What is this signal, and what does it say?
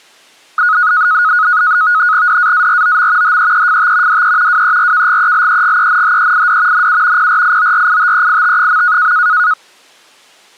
NAVTEX (SITOR-B), 100 baud, 170 Hz shift, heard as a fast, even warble, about 1360 Hz centre. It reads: DAAROM HEEFT DE WERKGELEGENHEID NU PRIORITEIT.